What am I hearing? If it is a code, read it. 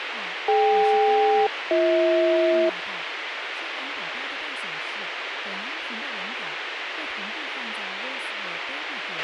Aircraft SELCAL, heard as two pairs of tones, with radio hiss, a squelch burst at the end and speech in Chinese. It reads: DK-BH